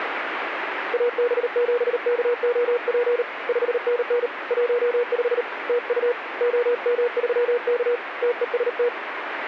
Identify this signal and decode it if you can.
Morse code, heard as a keyed tone, hand-sent with a paddle, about 38 wpm, 480 Hz, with radio static. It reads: AB7KOP 5NN 15 TU OM3K TEST